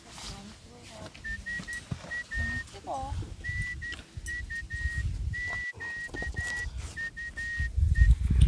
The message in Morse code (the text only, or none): SA NUQUE